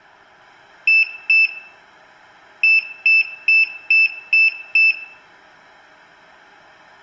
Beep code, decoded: 2-6

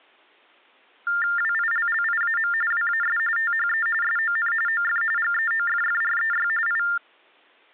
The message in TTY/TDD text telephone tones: WILLIAM WAS THE SON OF GEOFFREY I

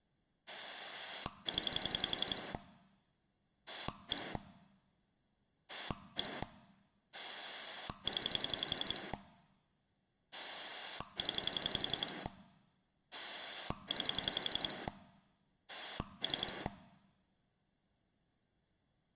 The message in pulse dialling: 0 1 1 0 0 9 3

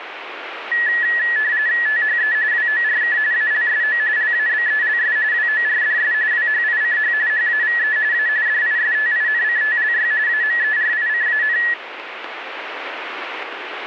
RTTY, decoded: THE WORK ALSO LABELS WORDS WHICH HAVE A DISTINCTLY AMERICAN

